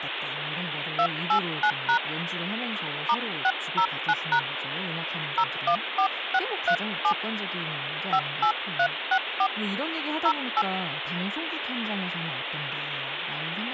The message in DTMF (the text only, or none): 289# *609# 014637 58364 08